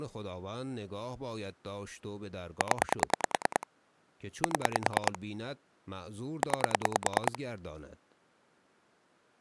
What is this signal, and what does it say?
Pulse dialling, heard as clicks on a phone line, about 10 pulses a second, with speech in Persian. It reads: 0 7 9